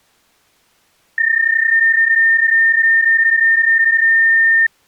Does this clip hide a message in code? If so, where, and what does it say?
Yes: PSK31 (31.25 baud) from 1.2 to 4.7 s, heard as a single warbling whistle, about 1800 Hz.